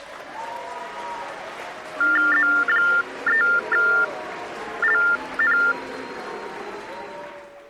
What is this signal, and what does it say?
TTY/TDD text telephone tones (45.45 baud Baudot), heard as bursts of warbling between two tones, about 400 Hz shift, 1600 Hz centre. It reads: Z3LN